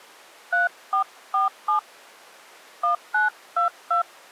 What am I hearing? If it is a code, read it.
DTMF, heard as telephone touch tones, dialled by hand, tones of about 120 ms. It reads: 3447 1922